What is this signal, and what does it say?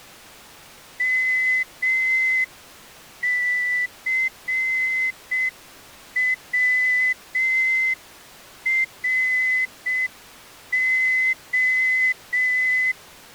Morse code, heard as a whistle, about 6 wpm. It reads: MCWRO